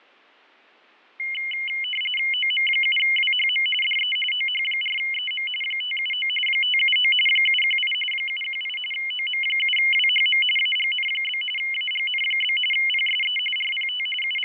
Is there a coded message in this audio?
Yes: RTTY (45.45 baud, 850 Hz shift) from 1.2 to 14.5 s, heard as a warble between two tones, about 2550 Hz centre, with fading. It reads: OM7WHM DE OH4EM 579 579 718 718 OM7WHM AGN? AGN? PSE RPT …